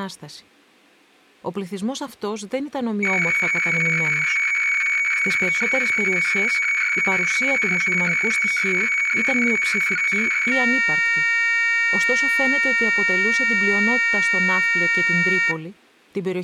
Weather fax (radiofax), 120 lines a minute, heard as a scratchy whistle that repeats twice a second, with room echo and speech in Greek.